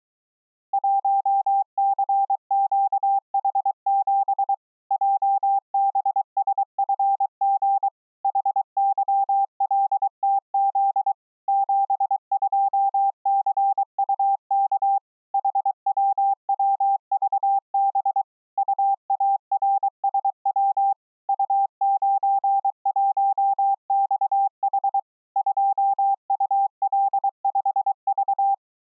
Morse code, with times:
0.7-4.5 1CQH7
4.9-7.9 JBSFG
8.2-11.1 HYLTZ
11.5-15.0 72CUK
15.3-18.2 HWWVB
18.6-20.9 UARSW
21.3-25.0 U91XH
25.4-28.5 2UL5V

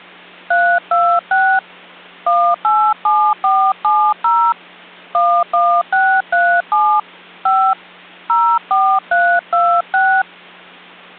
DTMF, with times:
0.5-1.6 326
2.3-4.5 187470
5.1-7.0 11637
7.5-7.7 5
8.3-10.2 04326

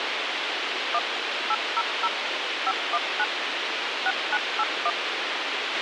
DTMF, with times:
0.9-1.0 1
1.5-2.1 800
2.7-3.2 519
4.1-4.9 6981

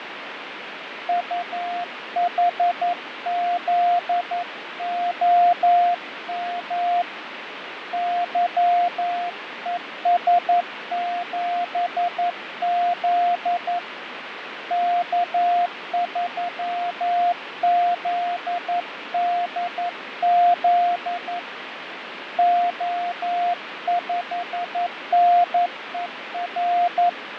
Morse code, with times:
1.1-7.0 UHZOM
7.9-13.8 YES7Z
14.7-21.4 K3ZDZ
22.4-27.1 O5NER

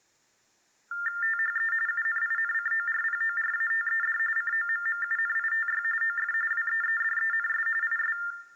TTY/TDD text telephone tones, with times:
1.2-1.7 THE
1.9-4.2 UNINCORPORATED
4.4-5.8 COMMUNITY
6.0-6.3 OF
6.5-7.7 WEEDENS
7.8-8.2 IS

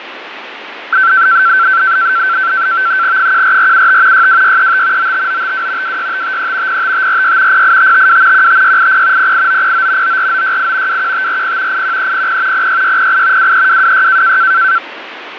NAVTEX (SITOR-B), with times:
3.2-4.3 14475
4.1-5.1 62635
5.0-6.0 95952
5.8-6.8 26553
6.7-7.6 05546
7.5-8.5 08552
8.3-9.3 15680
9.2-10.2 08909
10.0-11.0 94968
10.9-11.8 21540
11.7-12.7 81300
12.5-13.5 06608
13.4-14.4 23226

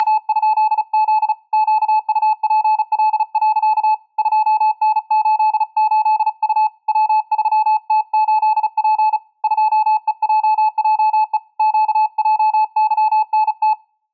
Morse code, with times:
0.0-1.3 …
1.5-3.9 QUPL.
4.2-6.7 2N88U
6.9-9.2 W3T8P
9.4-11.4 2EJJE
11.6-13.7 QJYNT

